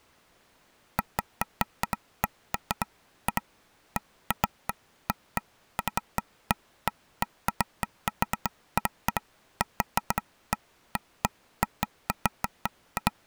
Irregular taps on a table. There is no code.